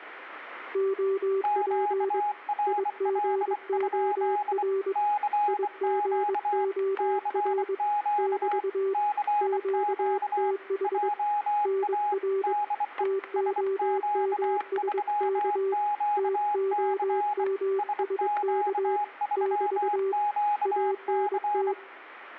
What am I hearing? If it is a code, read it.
Morse code, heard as two keyed tones, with static crashes and room echo. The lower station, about 22 wpm, 390 Hz: OP IGOR IGOR <BT> QTH NR TOMSK TOMSK <BT> ANT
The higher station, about 24 wpm, 830 Hz: QRL? CQ CQ CQ JA DE SQ3QC SQ3QC